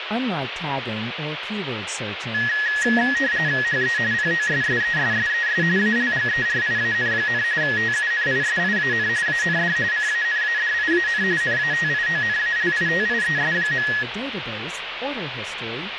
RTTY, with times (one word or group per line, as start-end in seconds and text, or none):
3.6-4.0 HE
4.1-5.6 POSSESSES
5.8-7.4 ALGERIAN,
7.6-9.1 TUNISIAN
9.3-9.8 AND
9.9-11.2 CANADIAN
11.4-13.9 NATIONALITIES.